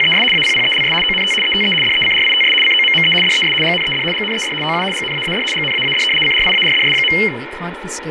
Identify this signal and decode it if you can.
RTTY (75 baud, 850 Hz shift), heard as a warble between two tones, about 2550 Hz centre, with radio static, fading and speech in English. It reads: … APPELS ONT ETE DECRITS COMME DES GNED GNED OU GNAAD GNAAD CRIARDS.